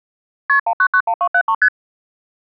Multi-frequency trunk signalling (R1, as on North American trunks), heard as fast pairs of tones, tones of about 70 ms. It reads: KP 1991273 ST